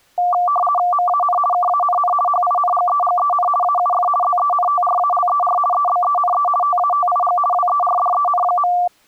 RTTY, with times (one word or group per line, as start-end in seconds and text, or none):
0.9-1.4 MAN
1.5-2.1 KANN
2.3-3.5 HINGEGEN
3.6-4.1 AUF
4.2-5.6 ZENTRALER
5.7-6.5 EBENE
6.6-7.4 TATIG
7.5-8.7 WERDEN.